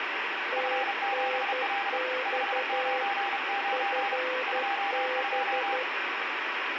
Morse code, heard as two keyed tones, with radio static. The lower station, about 12 wpm, 510 Hz: TNX FB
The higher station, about 32 wpm, 800 Hz: F7L 599 22